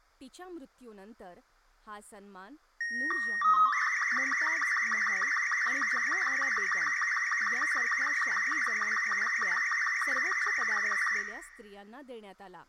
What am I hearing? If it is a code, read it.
SSTV (slow-scan television), Robot 36, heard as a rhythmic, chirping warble, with room echo and speech in Marathi.